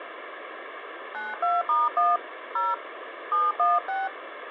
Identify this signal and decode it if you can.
DTMF, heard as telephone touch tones, dialled by hand, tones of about 190 ms, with phone line noise. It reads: 92*1 0 716